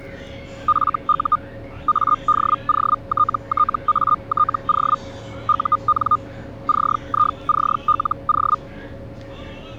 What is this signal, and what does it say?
Hellschreiber (Feld-Hell, 122.5 baud), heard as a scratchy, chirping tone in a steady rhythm, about 1220 Hz, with the noise inside a bus. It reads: FU ADOTTATO UN CICLO